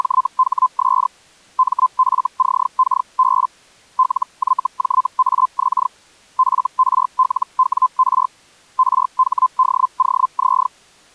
Hellschreiber (Feld-Hell, 122.5 baud), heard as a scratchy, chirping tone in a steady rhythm, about 1030 Hz. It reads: … MFCKB LYJAX FRLWR RHDOZ